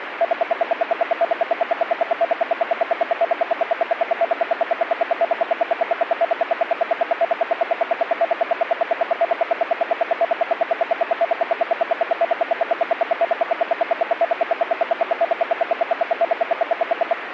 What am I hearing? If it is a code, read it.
Radio time signal (RWM, Moscow), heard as ten pulses a second, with radio static.